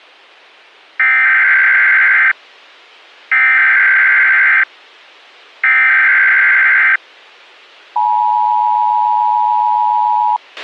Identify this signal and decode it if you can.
Emergency Alert System (SAME) tones (header bursts, then the 853 and 960 Hz attention tone), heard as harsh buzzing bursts, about 520.83 baud, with a squelch burst at the end.